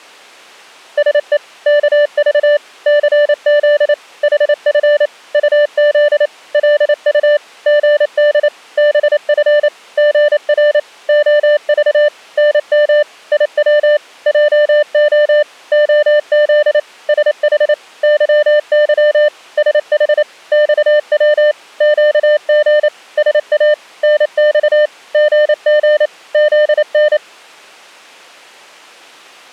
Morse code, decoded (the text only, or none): SE KV CZ HF UZ LU GD BF GR OV NM IW JO OZ SH YY SH XW QG SA NX GG ZN